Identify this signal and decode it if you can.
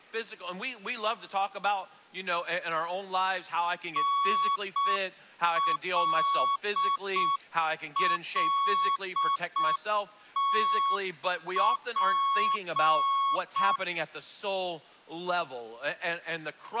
Morse code, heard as a keyed tone, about 6 wpm, 1110 Hz. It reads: NLLTP